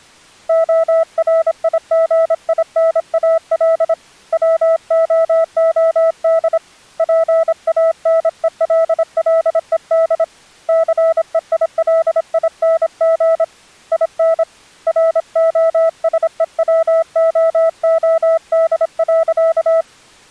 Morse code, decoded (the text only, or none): ORIGINAL WOOD PANELLED CEILING IN ROSEWOOD.